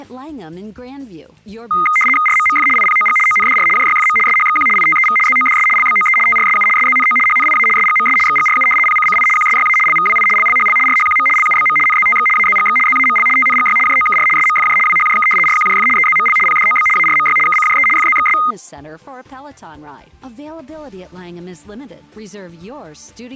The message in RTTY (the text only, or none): RMMF IPOG ONDR JYFM SHXQ ITEV ZODS LBOE TRSU SZNO HNIA SGMS XGRU PCCI QSYA LVWI LLHL RHQM LUBM NZTX AZGX ZAML TNGY JOKR SMFJ WHJK RQJF EZML PDOB ARMY KCJE FZXS